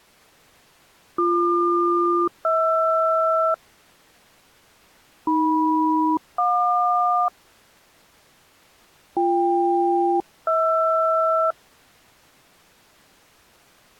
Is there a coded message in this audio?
Yes: aircraft SELCAL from 1.2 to 11.5 s, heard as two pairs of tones. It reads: BQ-HR AM-JQ BK-HR